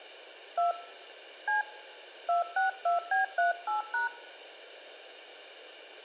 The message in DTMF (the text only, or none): 2 C 262B38#